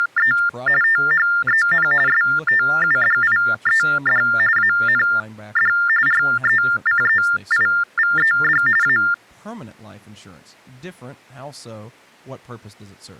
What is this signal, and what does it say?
TTY/TDD text telephone tones (45.45 baud Baudot), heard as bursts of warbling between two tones, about 400 Hz shift, 1600 Hz centre, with speech in English. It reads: … THEN STUDIED AND RECEIVED A